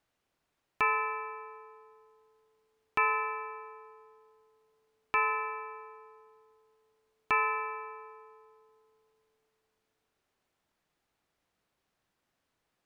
Clock strike, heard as a bell. 4. Four o'clock.